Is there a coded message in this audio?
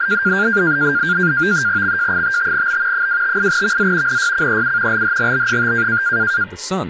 Yes: NAVTEX (SITOR-B), 100 baud, 170 Hz shift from 0.0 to 6.4 s, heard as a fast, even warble, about 1500 Hz centre, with speech in English. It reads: XJ55B 258VZ NYCEU LHGB5